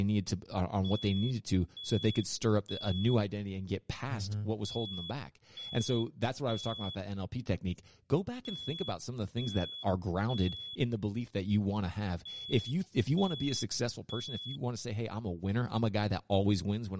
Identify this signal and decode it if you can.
Alarm pattern, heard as an alarm's beeps, played four times, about 3400 Hz, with speech in English. Temporal three. Smoke or fire, evacuate.